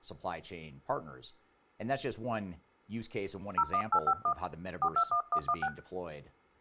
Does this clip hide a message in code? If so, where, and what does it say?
Yes: DTMF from 3.6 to 5.7 s, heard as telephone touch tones, dialled by hand, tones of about 80 ms, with speech in English. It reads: 01851 421116